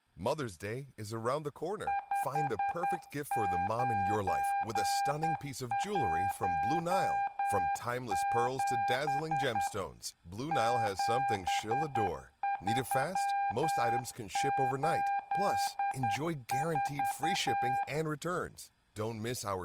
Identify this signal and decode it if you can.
Morse code, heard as a keyed tone, machine-sent, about 10 wpm, 800 Hz, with room echo and speech in English. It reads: 5917 7384